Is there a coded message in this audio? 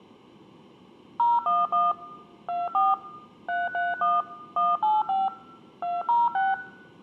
Yes: DTMF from 1.2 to 6.5 s, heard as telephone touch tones, dialled by machine, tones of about 190 ms, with room echo. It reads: 011 24 331 185 206